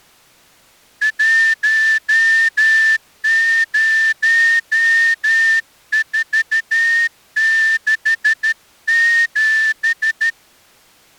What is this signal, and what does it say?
Morse code, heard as a whistle, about 13 wpm. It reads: 10467